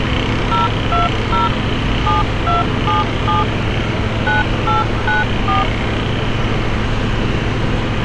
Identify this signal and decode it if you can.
DTMF, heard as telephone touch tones, dialled by machine, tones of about 160 ms, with street noise. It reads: 020 7277 9894